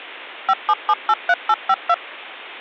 DTMF, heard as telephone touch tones, dialled by machine, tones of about 50 ms. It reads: 57783852